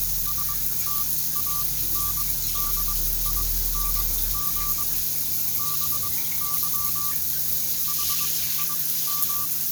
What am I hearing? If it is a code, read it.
Morse code, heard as a keyed tone, machine-sent, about 22 wpm, spaced as for 16 wpm, 1170 Hz, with the noise of a restroom. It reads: STANDING BY HIM